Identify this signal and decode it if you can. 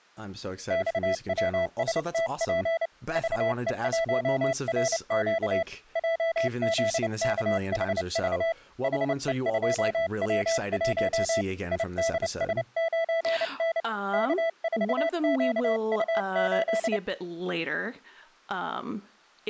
Morse code, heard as a keyed tone, hand-sent with a paddle, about 29 wpm, 660 Hz, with speech in English. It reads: XWSTP VE1RQ JZKHV HE2W1 IDS9N K4QU8